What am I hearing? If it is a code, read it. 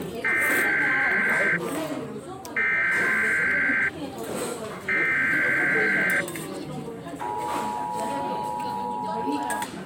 Emergency Alert System (SAME) tones (header bursts, then the 853 and 960 Hz attention tone), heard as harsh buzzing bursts, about 520.83 baud, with the noise of a restaurant.